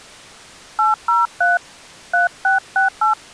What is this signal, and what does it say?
DTMF, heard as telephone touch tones, dialled by hand, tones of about 160 ms. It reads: 803 3668